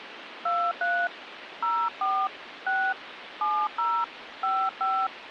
DTMF, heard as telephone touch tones, dialled by hand, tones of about 260 ms, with phone line noise. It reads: 23 04 6 70 55